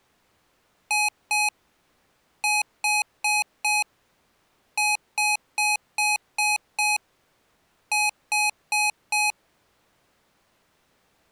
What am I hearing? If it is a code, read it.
Beep code, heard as beeps from a small speaker, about 840 Hz. 2-4-6-4.